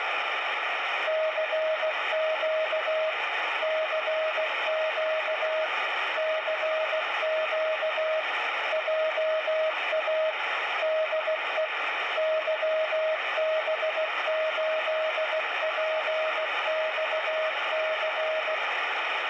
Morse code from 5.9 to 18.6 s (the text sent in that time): CQ JA DE YB8PXC